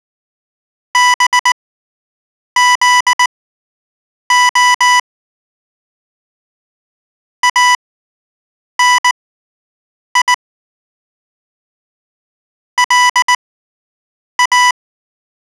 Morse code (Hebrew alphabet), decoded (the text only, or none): בזה אני לא